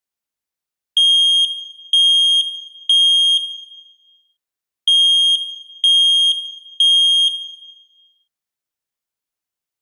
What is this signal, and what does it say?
Alarm pattern, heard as an alarm's beeps, played twice, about 3250 Hz, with room echo. Temporal three. Smoke or fire, evacuate.